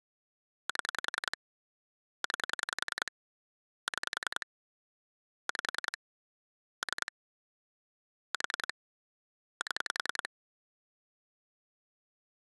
Pulse dialling, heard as clicks on a phone line, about 10 pulses a second. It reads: 7 9 6 5 3 4 7